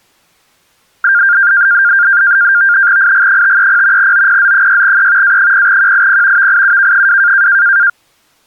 NAVTEX (SITOR-B), 100 baud, 170 Hz shift, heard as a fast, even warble, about 1500 Hz centre. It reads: IG530 OPZ6E A0QIP VIUK2